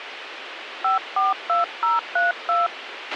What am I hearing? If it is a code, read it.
DTMF, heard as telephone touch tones, dialled by hand, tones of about 150 ms, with radio hiss and a squelch burst at the end. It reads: 542032